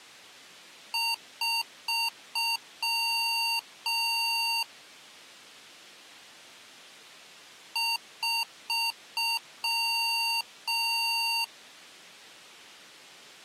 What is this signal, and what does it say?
Beep code, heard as beeps from a small speaker, played twice, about 920 Hz. 4 short, 2 long.